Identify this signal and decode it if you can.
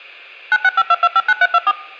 DTMF, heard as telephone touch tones, dialled by machine, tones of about 50 ms. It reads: 9652259324